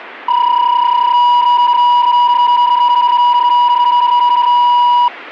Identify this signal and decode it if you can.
PSK31 (31.25 baud), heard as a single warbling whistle, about 970 Hz.